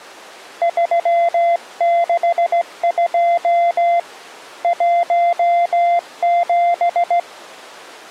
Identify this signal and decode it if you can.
Morse code, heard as a keyed tone, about 16 wpm, 690 Hz. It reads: 362 17